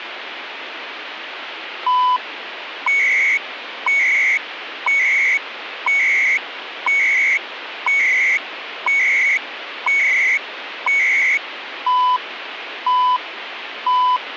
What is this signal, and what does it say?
Radio time signal (CHU, Canada), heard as beeps and data bursts, one a second, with radio static.